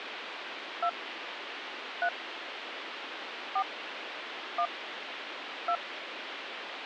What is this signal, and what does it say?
DTMF, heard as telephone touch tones, dialled by hand, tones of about 70 ms, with phone line noise. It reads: 2 3 4 1 2